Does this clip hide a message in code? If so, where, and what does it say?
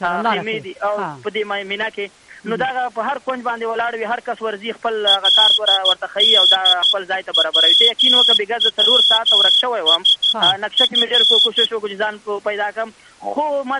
Yes: Morse code (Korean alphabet) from 5.0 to 11.7 s, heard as a whistle, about 13 wpm. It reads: 그뿐